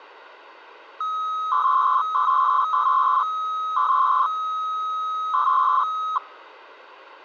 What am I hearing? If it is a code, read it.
300-baud modem data (Bell 103 tones), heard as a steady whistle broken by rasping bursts, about 300 baud, 200 Hz shift.